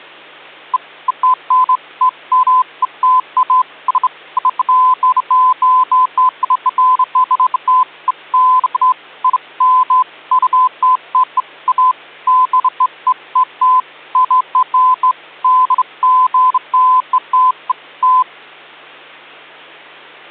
Beeps of irregular length, with hum. There is no code.